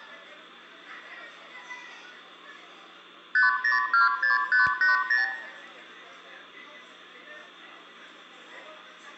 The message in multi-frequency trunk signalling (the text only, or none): 5026580